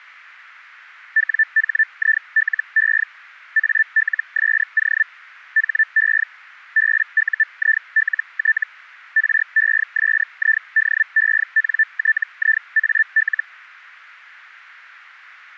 Hellschreiber (Feld-Hell, 122.5 baud), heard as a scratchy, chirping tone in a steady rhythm, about 1750 Hz. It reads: WHILE ALSO HE BUILT RESIDENTIAL